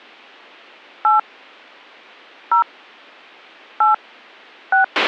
DTMF, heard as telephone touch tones, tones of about 120 ms, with a squelch burst at the end. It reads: 8 0 8 6